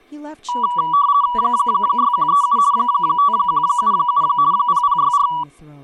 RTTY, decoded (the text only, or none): 6137 5177 0064